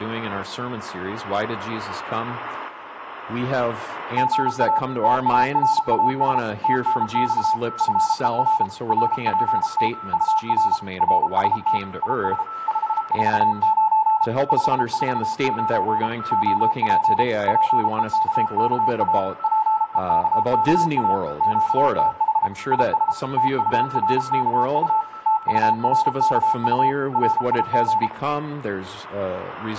Morse code, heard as a keyed tone, machine-sent, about 33 wpm, 880 Hz, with static crashes, a weaker station near 1320 Hz and room echo. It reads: GA TARAS TNX FER RPT UR RST IS 549 549 OP PEKKA PEKKA QTH IS TURKU TURKU RIG